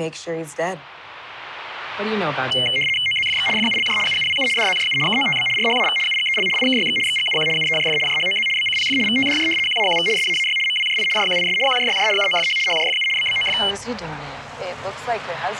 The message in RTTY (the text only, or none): OZFX FULJ UUWU DZJU KOTB RHAV UGEL IKYX XGUQ UEJF JHOZ BCPF VTDJ QAQV SAAY MWJI JQIS QJYJ UOFH HJFU BBOF